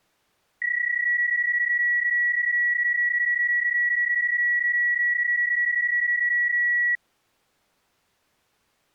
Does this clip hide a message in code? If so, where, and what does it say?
Yes: PSK31 (31.25 baud) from 0.6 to 7.0 s, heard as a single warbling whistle, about 1950 Hz.